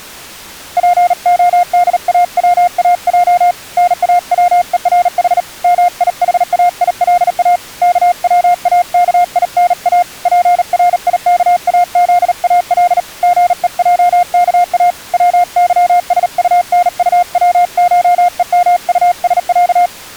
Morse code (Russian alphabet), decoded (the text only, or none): ПОДАВАЙ НАВЕРХ МИХАИЛА КВАКИНА ПРИКАЗАЛ ГЕЙКА ВЫСУНУВШЕМУСЯ